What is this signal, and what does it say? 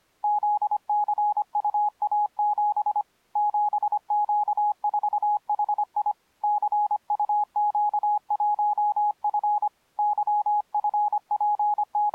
Morse code, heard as a keyed tone, hand-sent with a paddle, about 25 wpm, 830 Hz. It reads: ZCUA7 7Q4HI CUQ1F …